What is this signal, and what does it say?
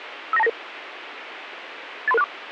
Five-tone selective call (EIA), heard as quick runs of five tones, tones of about 30 ms, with radio hiss. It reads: 59299 83364